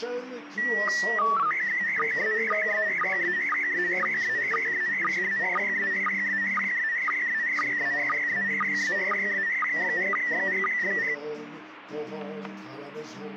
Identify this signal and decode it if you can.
SSTV (slow-scan television), PD 120, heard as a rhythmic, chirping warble, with radio static and static crashes.